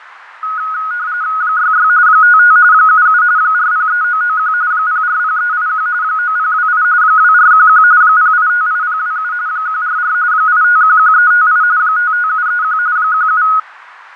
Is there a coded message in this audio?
Yes: RTTY (45.45 baud, 170 Hz shift) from 0.4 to 13.6 s, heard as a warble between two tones, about 1360 Hz centre, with radio static and fading. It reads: 66 55 77 403991 040381 9028 2411 0858027 144 8511358 55731 17